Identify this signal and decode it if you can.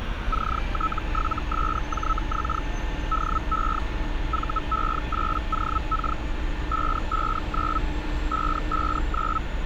Hellschreiber (Feld-Hell, 122.5 baud), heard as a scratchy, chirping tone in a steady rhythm, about 1300 Hz, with street noise. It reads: CT7SJX DE VE8OK 559 559